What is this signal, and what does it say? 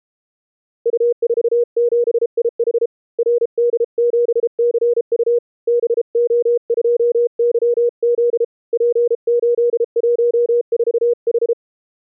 Morse code, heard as a keyed tone, hand-sent with a paddle, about 33 wpm, 480 Hz. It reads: U47IH RD7CU BO2YZ P814H